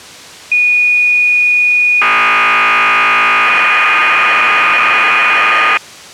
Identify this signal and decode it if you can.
Cassette data (Kansas City type), 1200 baud, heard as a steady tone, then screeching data.